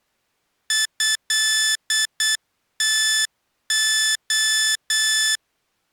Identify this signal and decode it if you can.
Morse code (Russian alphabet), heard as electronic beeps, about 8 wpm, 1750 Hz. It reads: ЭТО